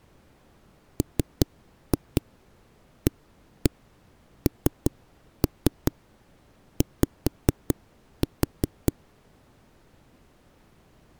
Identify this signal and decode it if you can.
Tap code, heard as knocks on a wall, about 5 knocks a second. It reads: MANY